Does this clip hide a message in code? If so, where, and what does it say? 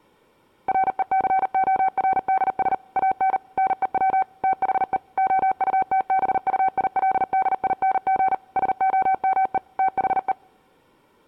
Yes: Morse code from 0.6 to 10.4 s, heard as a keyed tone, machine-sent, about 39 wpm, 760 Hz. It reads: RECORDS AN NEW THE OUTBUILDING SOME THE